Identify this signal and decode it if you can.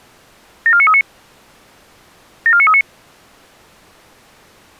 Five-tone selective call (ZVEI), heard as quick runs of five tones, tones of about 70 ms. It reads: 74939 74939